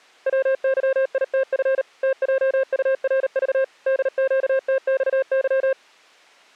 Morse code, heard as a keyed tone, machine-sent, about 38 wpm, 530 Hz. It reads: WYITF TJURV DQTXY